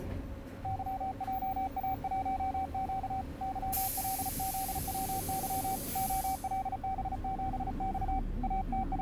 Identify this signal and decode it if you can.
Morse code, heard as a keyed tone, hand-sent with a paddle, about 35 wpm, 770 Hz, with the noise inside a bus. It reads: YJA1Q YLZWY OLB7X …